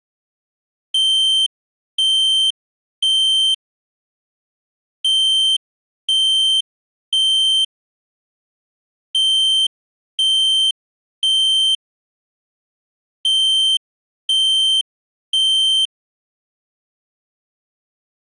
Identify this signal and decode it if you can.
Alarm pattern, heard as an alarm's beeps, played four times, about 3100 Hz. Temporal three. Smoke or fire, evacuate.